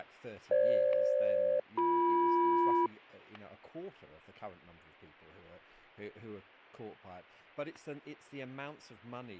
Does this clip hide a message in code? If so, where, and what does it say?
Yes: aircraft SELCAL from 0.5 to 2.9 s, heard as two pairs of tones, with static crashes and speech in English. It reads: FG-BM